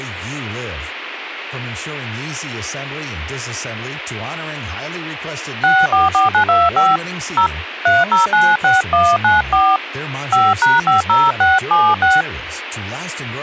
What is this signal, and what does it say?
DTMF, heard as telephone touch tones, dialled by hand, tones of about 160 ms, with radio hiss and speech in English. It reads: 644925 0 3096194 5#50676